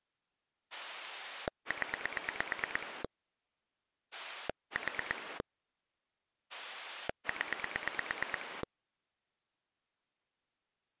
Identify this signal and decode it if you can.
Pulse dialling, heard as a rotary dial, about 9 pulses a second. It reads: 0 4 0